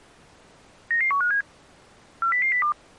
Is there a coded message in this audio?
Yes: five-tone selective call (CCIR) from 0.9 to 2.7 s, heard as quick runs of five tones, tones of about 100 ms. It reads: 99157 40002